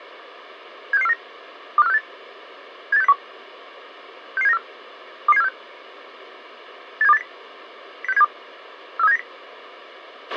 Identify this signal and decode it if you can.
Five-tone selective call (EEA), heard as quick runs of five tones, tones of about 40 ms, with a squelch burst at the end. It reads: 76649 25468 78601 66794 22746 87280 06072 43790